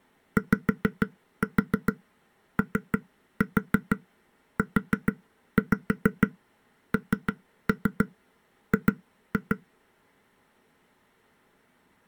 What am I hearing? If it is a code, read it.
Tap code, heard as taps on a table, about 6 knocks a second. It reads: YOUNG